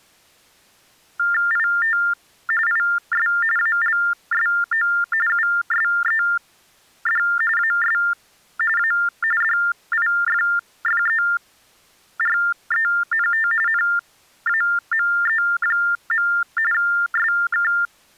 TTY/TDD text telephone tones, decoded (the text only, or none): IT IS ALSO USED AS A DIFFERENT NAME. SK